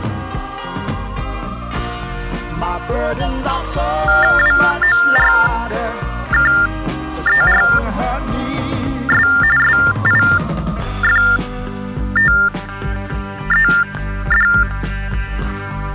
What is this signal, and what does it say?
TTY/TDD text telephone tones (45.45 baud Baudot), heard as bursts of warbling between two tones, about 400 Hz shift, 1600 Hz centre. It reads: WORKERS SIFTED